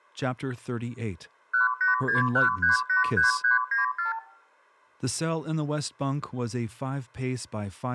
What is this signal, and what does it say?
Multi-frequency trunk signalling (R2, with the far end's replies), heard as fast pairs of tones, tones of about 140 ms, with room echo and speech in English. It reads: 1861383394